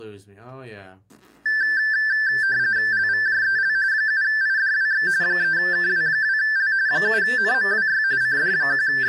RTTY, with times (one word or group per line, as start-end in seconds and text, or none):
2.9-3.8 LVJEL
3.9-5.1 7IDWX
5.2-6.7 3KW2L
6.9-8.0 7NMWY
8.2-9.1 …